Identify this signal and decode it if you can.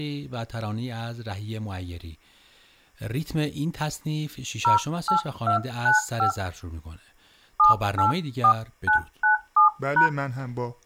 DTMF, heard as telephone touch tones, dialled by hand, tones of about 110 ms, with speech in Persian. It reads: 08295 784997#